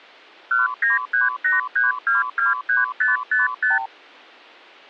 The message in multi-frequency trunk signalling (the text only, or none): 19383223555